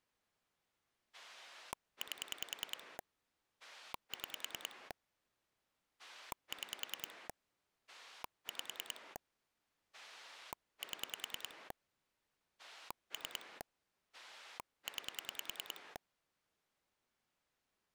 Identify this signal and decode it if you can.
Pulse dialling, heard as a rotary dial, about 10 pulses a second. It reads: 8 6 6 5 7 3 9